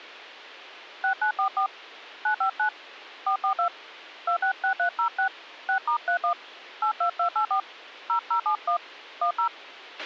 DTMF, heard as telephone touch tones, dialled by hand, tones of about 100 ms, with a squelch burst at the end. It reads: 6944 959 442 266306 6*31 82284 0071 10